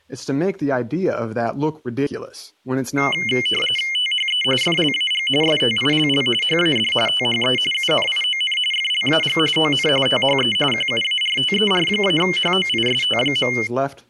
RTTY (45.45 baud, 850 Hz shift), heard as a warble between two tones, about 2550 Hz centre, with speech in English. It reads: THE FLAG STILL HAD THE UNION FLAG ON THE QUARTER-HOIST.